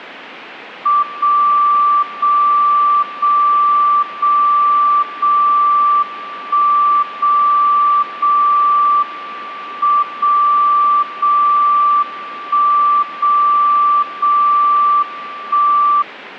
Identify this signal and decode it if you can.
Radio time signal (WWVB), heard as a tone whose level steps once a second, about 1170 Hz. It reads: 0 0 0 0 0 1 0 0 M 0 0 1 0 0 1